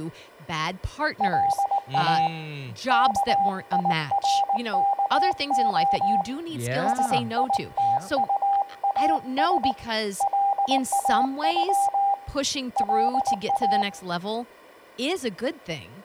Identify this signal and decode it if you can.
Morse code (with Esperanto letters), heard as a keyed tone, hand-sent with a paddle, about 19 wpm, 800 Hz, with room echo and speech in English. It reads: LA KIRKO SITUAS LAŬ LA